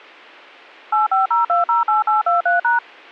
DTMF, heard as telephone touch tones, dialled by machine, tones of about 140 ms, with a squelch burst at the end. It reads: 850208823#